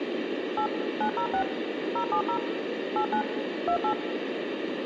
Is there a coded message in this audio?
Yes: DTMF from 0.6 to 3.9 s, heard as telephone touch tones, dialled by machine, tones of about 90 ms, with phone line noise. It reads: 8 906 070 89 28